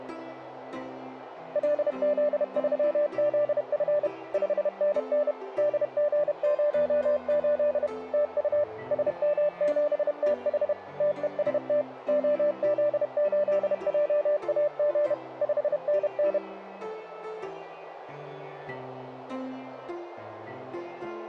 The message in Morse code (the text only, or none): LZ3ZF 5NN DG08 TU SM7TH TEST OZ8JAG 5NN